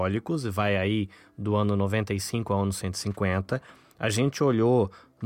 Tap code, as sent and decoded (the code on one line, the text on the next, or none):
none